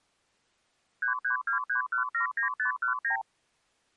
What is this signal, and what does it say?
Multi-frequency trunk signalling (R2, with the far end's replies), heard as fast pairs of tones, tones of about 110 ms. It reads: 3323179519